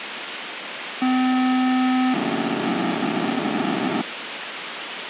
POCSAG pager data (512 baud), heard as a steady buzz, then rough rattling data, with radio hiss.